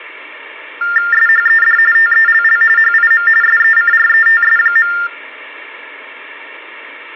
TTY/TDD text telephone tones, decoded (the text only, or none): SHED TELL HIM SECRETS.